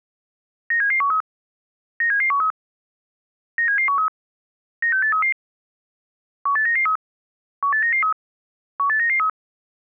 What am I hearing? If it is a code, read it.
Five-tone selective call (CCIR), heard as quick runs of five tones, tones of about 100 ms. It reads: 97713 97713 97713 96833 18993 18993 18993